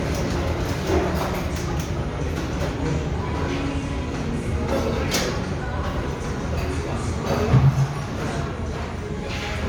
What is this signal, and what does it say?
The noise of a restaurant. There is no code.